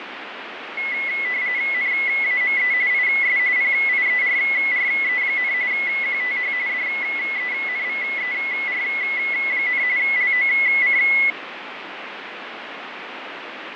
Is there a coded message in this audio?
Yes: RTTY (45.45 baud, 170 Hz shift) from 0.8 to 11.3 s, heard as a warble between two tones, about 2100 Hz centre, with radio static. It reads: NAME IS PIERRE, QTH DENVER, LOC